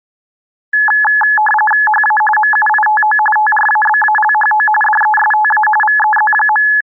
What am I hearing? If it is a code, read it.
RTTY (45.45 baud, 850 Hz shift), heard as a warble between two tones, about 1280 Hz centre. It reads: HA MUITO TRABALHO DESTA VEZ.